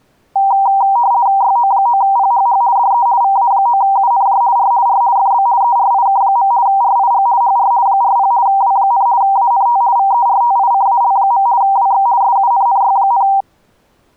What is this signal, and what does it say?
RTTY (50 baud, 170 Hz shift), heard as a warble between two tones, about 870 Hz centre. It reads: YO9PHH DE VA9UNJ R R FB ERIK. RIG HR 40 W, ANT VERTICAL. WX SUNNY,